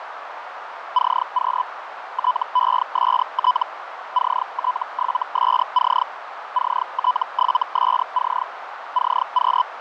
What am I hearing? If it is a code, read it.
Hellschreiber (Feld-Hell, 122.5 baud), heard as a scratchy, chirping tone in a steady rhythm, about 1000 Hz, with radio static and a narrow filter. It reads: CQ TEST CT7SC CT7SC CQ